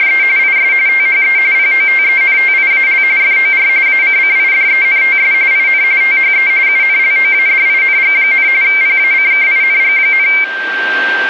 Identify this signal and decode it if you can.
RTTY (45.45 baud, 170 Hz shift), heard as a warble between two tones, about 2200 Hz centre, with radio static and a steady whistle near 1570 Hz. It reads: … IS THE POTENTIAL FOR ACCIDENTS IN THE UNLOADING, PACKING,